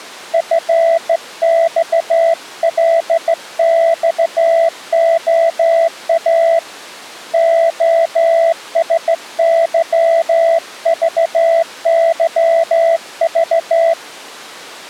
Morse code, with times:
0.3-6.6 FXLXOA
7.3-13.9 OSYVYV

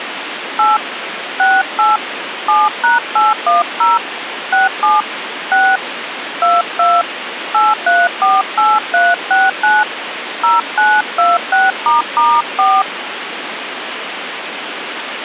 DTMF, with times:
0.6-0.8 8
1.4-2.0 68
2.5-4.0 7#810
4.5-5.0 67
5.5-5.8 6
6.4-7.0 22
7.5-9.8 8348369
10.4-12.8 0926**4

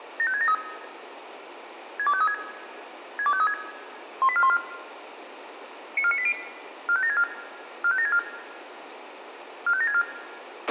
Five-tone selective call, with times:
0.2-0.5 75673
2.0-2.3 62536
3.2-3.5 62536
4.2-4.6 18414
6.0-6.3 94980
6.9-7.2 45764
7.8-8.2 45764
9.7-10.0 45764

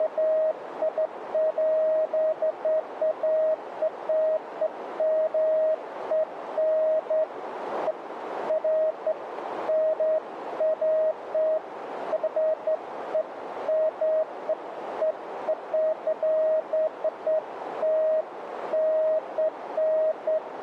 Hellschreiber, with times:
none

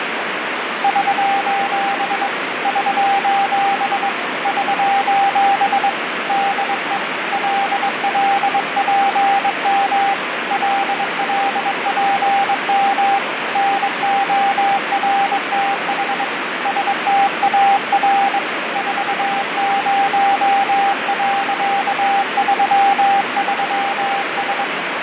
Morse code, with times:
0.8-2.3 <SOS>
2.7-4.1 <SOS>
4.5-5.9 <SOS>
6.3-7.0 DE
7.3-10.1 LLPM
10.5-13.2 LLPM
13.6-16.2 NORTH
16.7-18.4 STAR
18.8-24.6 40.33S

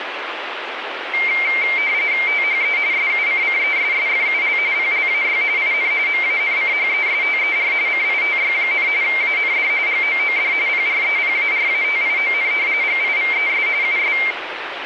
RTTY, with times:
2.3-2.8 THE
2.9-4.6 SUCCESSFUL
4.7-5.4 PLAY
5.6-5.9 IN
6.1-7.7 MANCHESTER
7.9-8.9 CITY,
9.0-9.7 AND
9.9-10.5 GOOD
10.7-12.5 PREPARATION
12.8-13.7 GIVES
13.8-14.2 US

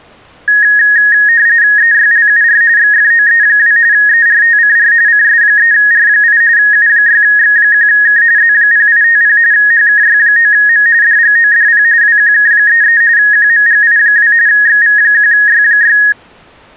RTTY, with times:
1.8-2.6 EYLUR
2.8-3.8 XFOE2
3.9-4.9 ERTCR
5.1-6.4 CS3R8
6.6-8.2 U6X1K
8.4-9.4 Z0850
9.5-10.9 HKY9M
11.0-11.8 DGODP
12.0-13.0 WQK33
13.2-14.3 QMGI2
14.5-16.0 XV1Y6

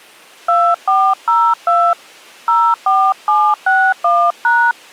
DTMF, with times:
0.5-1.9 2402
2.5-4.7 04761#

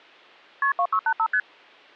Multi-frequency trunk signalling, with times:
0.6-0.7 KP
0.8-1.3 2685
1.3-1.4 ST

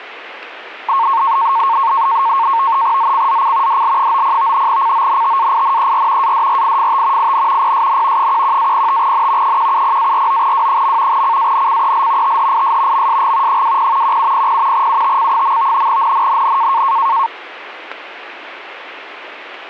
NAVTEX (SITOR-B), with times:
3.0-3.8 ZCZC
3.7-4.7 DL90
4.7-6.3 CONTAINER
6.2-7.3 ADRIFT
7.2-7.7 IN
7.6-8.3 PSN
8.2-9.6 11-05N
9.4-11.2 170-49W.
11.1-12.4 CANCEL
12.2-13.1 THIS
12.9-13.6 MSG
13.5-14.2 20
14.0-14.9 1700
14.7-15.9 UTC.
15.9-16.8 NNNN

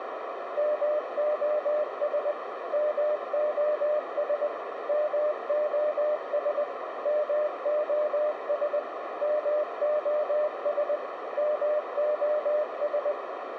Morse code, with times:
0.6-2.3 MOS
2.7-4.5 MOS
4.9-6.6 MOS
7.1-8.8 MOS
9.2-11.0 MOS
11.4-13.1 MOS

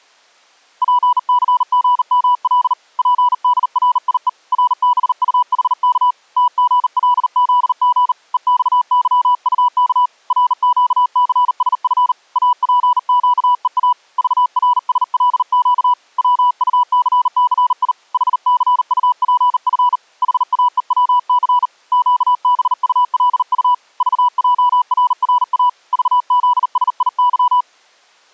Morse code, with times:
0.8-2.7 PCGML
3.0-4.3 PDRIE
4.5-6.1 RBUHK
6.4-8.1 TGLZG
8.3-10.1 EXYUK
10.3-12.1 RQCSF
12.4-13.9 APQEA
14.2-15.9 VRSLQ
16.2-17.9 WUCCI
18.1-20.0 HCUPF
20.2-21.7 HAEWC
21.9-23.7 QBULU
24.0-25.7 VJRRA
25.9-27.6 VZSIY

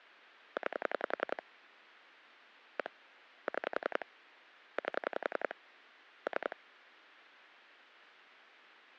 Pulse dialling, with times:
0.6-1.4 9
2.8-2.9 1
3.5-4.0 6
4.8-5.5 8
6.3-6.6 3

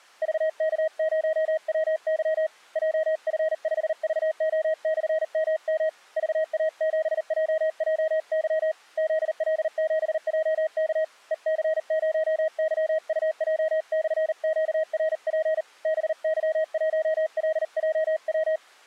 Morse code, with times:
0.2-2.5 VK0WY
2.8-5.9 JF5VO/MM
6.2-8.7 VA7JJY
9.0-11.0 ZL7JK
11.3-15.6 EC0YUJ/QRP
15.9-18.6 BY1LJW

